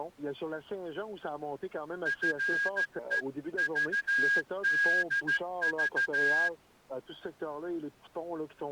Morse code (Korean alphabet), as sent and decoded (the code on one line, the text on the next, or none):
..-. . ...- -.. ...-
나를